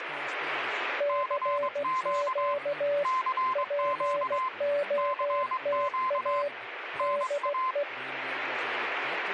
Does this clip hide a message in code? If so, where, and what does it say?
Yes: Morse code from 0.9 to 7.9 s, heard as two keyed tones, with radio static. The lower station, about 16 wpm, 580 Hz: CQ POTA DE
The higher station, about 22 wpm, 1040 Hz: CQ CQ CQ NA